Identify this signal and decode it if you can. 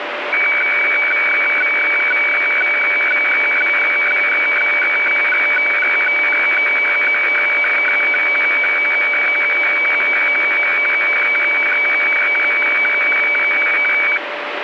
Weather fax (radiofax), 120 lines a minute, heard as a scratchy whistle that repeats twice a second, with radio static.